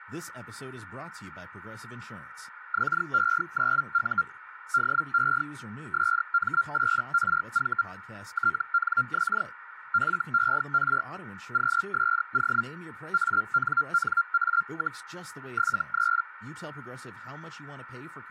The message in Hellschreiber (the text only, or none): XE9U DE SM8RV TNX FER QSO ANNA, 73